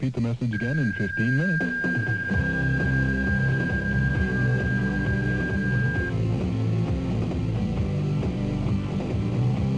PSK31 (31.25 baud), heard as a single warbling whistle, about 1600 Hz.